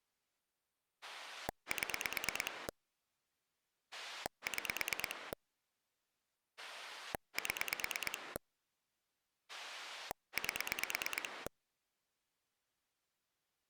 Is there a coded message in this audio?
Yes: pulse dialling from 1.0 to 11.5 s, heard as a rotary dial, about 9 pulses a second. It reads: 7 6 7 8